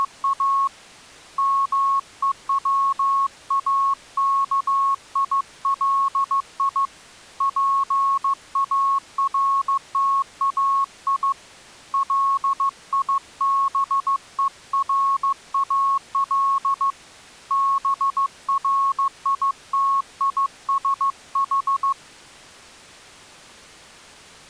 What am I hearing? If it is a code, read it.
Morse code, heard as a keyed tone, hand-sent with a paddle, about 15 wpm, 1100 Hz. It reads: … MEWAKILI PARTAI LIBERAL BRITISH